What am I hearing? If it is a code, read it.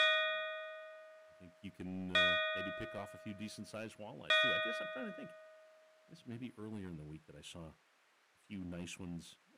Clock strike, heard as a bell, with speech in English. 3. Three o'clock.